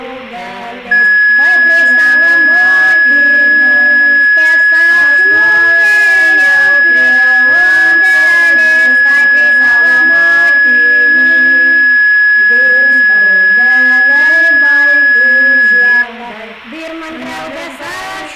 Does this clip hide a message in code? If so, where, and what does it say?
No, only a steady tone.